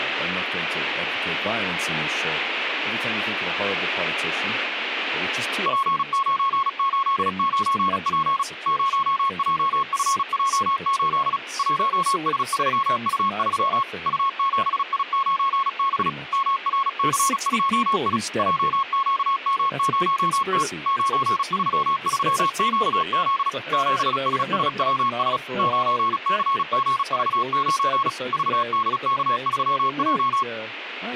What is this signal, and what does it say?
Morse code, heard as a keyed tone, machine-sent, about 36 wpm, 1090 Hz. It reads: P989P 0JFJ8 1S3U3 U7I9B MRC2I JQM0T 933QZ 7SSWS 9CGV9 VDK3J